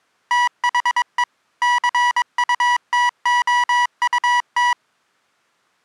Morse code, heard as electronic beeps, machine-sent, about 22 wpm, 970 Hz. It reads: THE CUTOUT